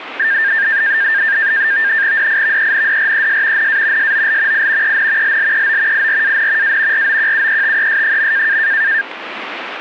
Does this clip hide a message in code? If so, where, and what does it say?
Yes: NAVTEX (SITOR-B), 100 baud, 170 Hz shift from 0.2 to 9.0 s, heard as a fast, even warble, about 1700 Hz centre, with radio static. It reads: DIVENDRES NA SOL I EN LLEO IRAN A ROQUETES.